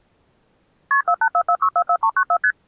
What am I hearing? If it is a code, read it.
Multi-frequency trunk signalling (R1, as on North American trunks), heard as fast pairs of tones, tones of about 70 ms. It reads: KP 4844644394 ST